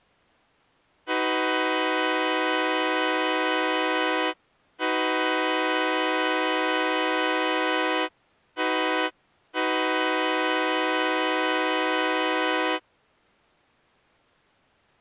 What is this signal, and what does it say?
Train horn signal, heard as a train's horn. 2 long, 1 short, 1 long. On North American railways: approaching a public crossing.